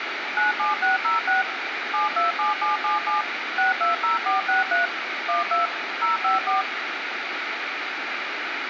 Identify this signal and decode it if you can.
DTMF, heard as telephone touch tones, dialled by machine, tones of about 140 ms, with radio hiss. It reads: 97606 727777 620463 12 054